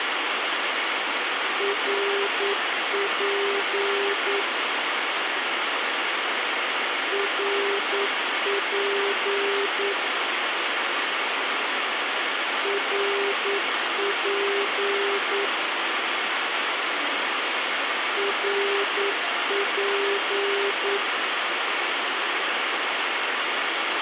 Morse code, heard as a keyed tone, machine-sent, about 9 wpm, 400 Hz, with radio hiss and a squelch burst at the end. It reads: RP RP RP RP